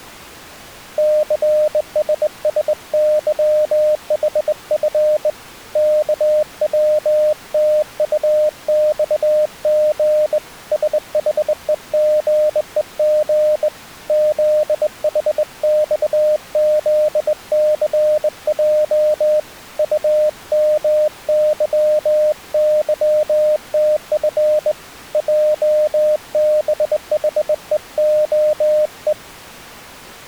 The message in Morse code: CSSYHF KWTUXG SHEGEG ZHXZCJ UMYYTF JBHEOE

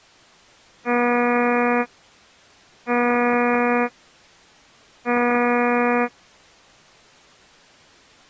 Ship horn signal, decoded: 3 short

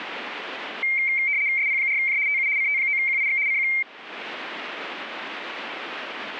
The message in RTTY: SP4J TU CT9QIX CQ

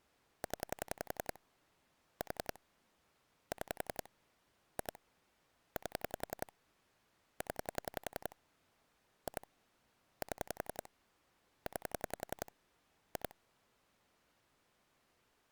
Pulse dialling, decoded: 0 4 6 2 8 0 2 7 9 2

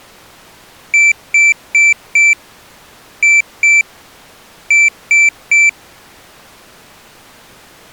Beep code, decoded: 4-2-3

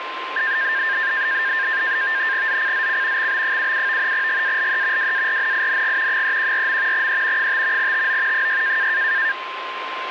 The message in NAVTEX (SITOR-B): ZCZC XB77 GALE WARNING 314. E 5 TO 6

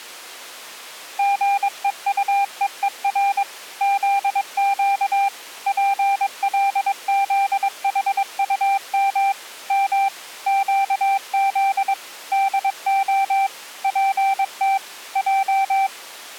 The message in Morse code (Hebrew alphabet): גוטוור זק פלזחטם מ קז דה פת ע

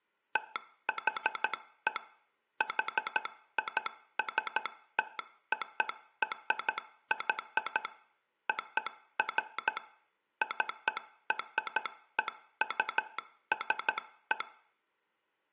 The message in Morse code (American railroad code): THE HISTORY OF CREUSE

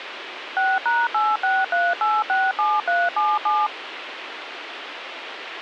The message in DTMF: 6#863867377

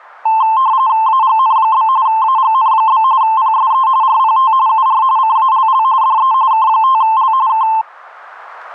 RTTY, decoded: AGN? AGN? PSE RPT UR CALL DE K5L K

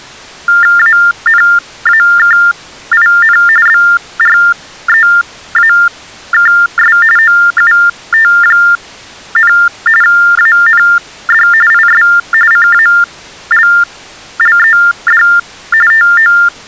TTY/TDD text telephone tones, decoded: ANAKIN BREAKS OUT, AND IS CALLED TO

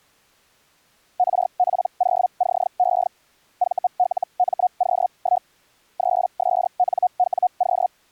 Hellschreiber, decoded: RP0CE VLMQ1 3SNWQ

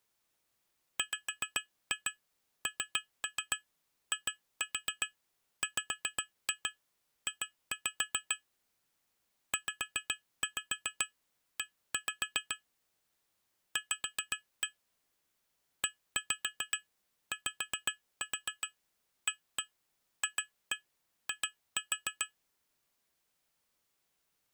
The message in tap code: WNIWJ ZE V EYAFI

